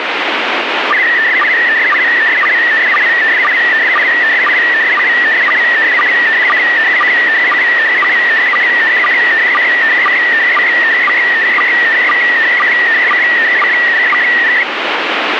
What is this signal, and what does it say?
SSTV (slow-scan television), PD 120, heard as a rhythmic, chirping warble, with radio static.